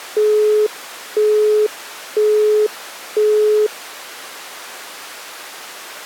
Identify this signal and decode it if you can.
Telephone call progress tone (single-tone plan, as in Europe, Japan and elsewhere), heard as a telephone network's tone, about 420 Hz, 0.5 s on and 0.5 s off. Busy tone.